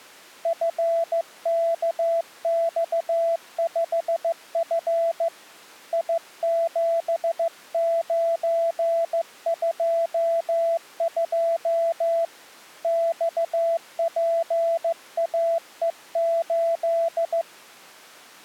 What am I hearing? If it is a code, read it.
Morse code, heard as a keyed tone, hand-sent with a straight key, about 15 wpm, 670 Hz. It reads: FKX5F I7922 XPAE8